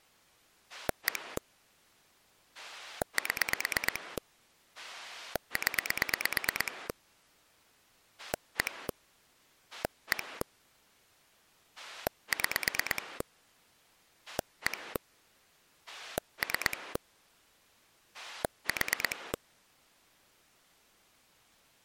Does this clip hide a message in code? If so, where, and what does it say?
Yes: pulse dialling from 0.7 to 19.4 s, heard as a rotary dial, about 9 pulses a second. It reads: 1 7 0 1 1 6 1 3 4